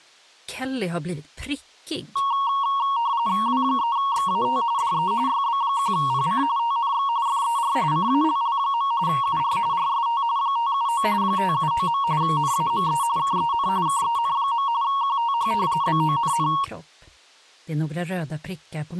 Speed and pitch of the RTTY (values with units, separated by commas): 45.45 baud, 170 Hz shift, 1020 Hz centre